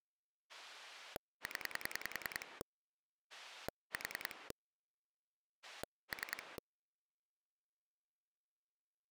Pulse dialling, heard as a rotary dial, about 10 pulses a second. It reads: 0 4 3